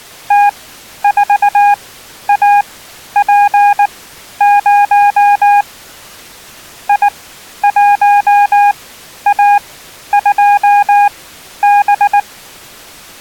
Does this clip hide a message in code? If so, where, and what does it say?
Yes: Morse code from 0.2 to 12.3 s, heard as a keyed tone, machine-sent, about 19 wpm, spaced as for 11 wpm, 820 Hz. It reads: T4AP0 I1A2B